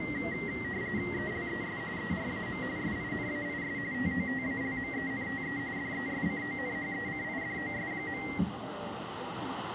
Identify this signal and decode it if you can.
RTTY (45.45 baud, 170 Hz shift), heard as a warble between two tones, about 2000 Hz centre, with radio static, room echo and the noise inside a subway train. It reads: ELES ERAM SINAIS TOTALMENTE DESCONHECIDOS.